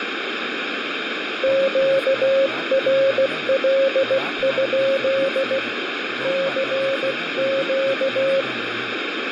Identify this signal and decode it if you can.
Morse code, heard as a keyed tone, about 16 wpm, 540 Hz, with radio static and speech in Punjabi. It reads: QRL? CQ